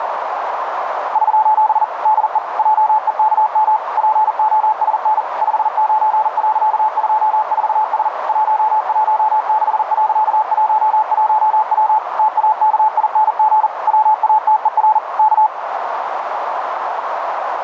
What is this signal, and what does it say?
Morse code, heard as a keyed tone, machine-sent, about 40 wpm, 860 Hz, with heavy radio static and a narrow filter. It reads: <SOS> DE JEKM POSN 59.24S 116.11W TAKING WATER K